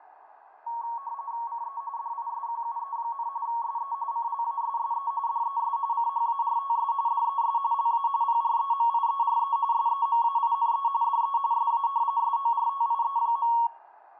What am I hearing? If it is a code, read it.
RTTY (45.45 baud, 170 Hz shift), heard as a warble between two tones, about 1020 Hz centre, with radio static and fading. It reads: CE DISQUE, SE CLASSE DES CHARTS DES LA PREMIERE SEMAINE DE SA SORTIE.